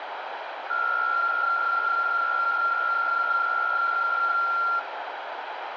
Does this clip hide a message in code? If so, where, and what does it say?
Yes: PSK63 (62.5 baud) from 0.7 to 4.8 s, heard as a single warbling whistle, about 1380 Hz, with radio static and room echo.